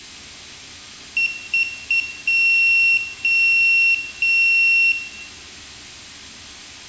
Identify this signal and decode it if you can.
Beep code, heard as a piezo beeper, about 2700 Hz, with room echo. 3 short, 3 long.